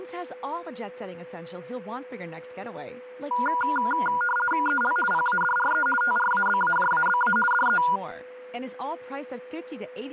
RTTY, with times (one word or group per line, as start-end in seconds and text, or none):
4.7-5.0 EL
5.1-5.9 PADRE
6.0-7.4 TRABAJABA
7.5-7.8 DE